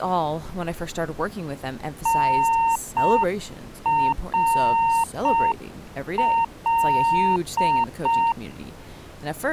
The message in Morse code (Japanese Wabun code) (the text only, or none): タナカ